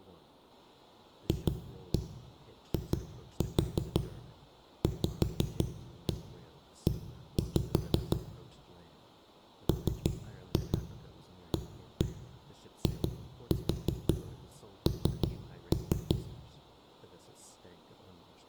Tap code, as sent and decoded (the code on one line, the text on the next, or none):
2-1 2-4 5-1 1-5 / 3-2 1-1 2-4 3-3
FIVE MAIN